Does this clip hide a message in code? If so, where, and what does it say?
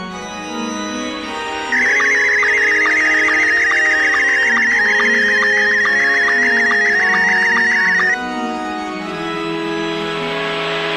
Yes: SSTV (slow-scan television), Scottie S1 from 1.7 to 8.1 s, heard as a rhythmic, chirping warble.